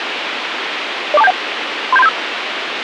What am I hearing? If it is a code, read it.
Five-tone selective call (EIA), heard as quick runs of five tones, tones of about 30 ms, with radio hiss. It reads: 04271 37375